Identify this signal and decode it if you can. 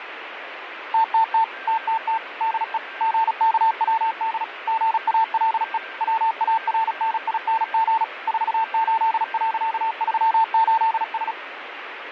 Morse code, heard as a keyed tone, machine-sent, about 36 wpm, 900 Hz, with radio static, fading and a weaker station near 1580 Hz. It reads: TTT TTT DE GKWD GALE WARNING 48.38S